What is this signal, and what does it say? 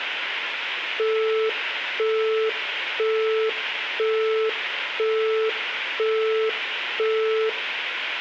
Telephone call progress tone (single-tone plan, as in Europe, Japan and elsewhere), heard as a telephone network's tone, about 440 Hz, 0.5 s on and 0.5 s off, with phone line noise and room echo. Busy tone.